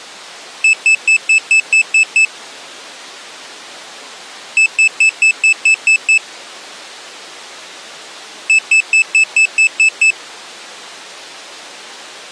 Beep code, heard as a piezo beeper, played three times, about 2600 Hz. 8 short. In AMI BIOS tables: display memory failure; in Dell tables: LCD failure.